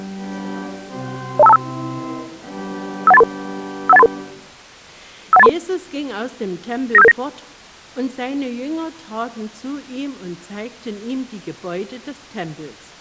Five-tone selective call (EIA), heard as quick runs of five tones, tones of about 30 ms. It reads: 02525 51833 51833 51833 95779